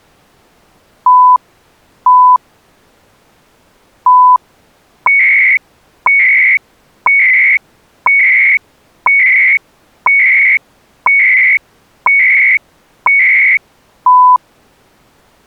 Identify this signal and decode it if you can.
Radio time signal (CHU, Canada), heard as beeps and data bursts, one a second.